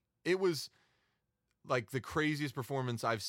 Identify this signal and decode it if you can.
Speech in English. There is no code.